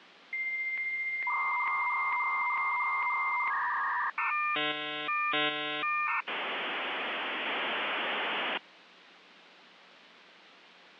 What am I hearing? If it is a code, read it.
Dial-up modem handshake (V.34 or later), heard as a whistle, warbles, then hiss, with phone line noise.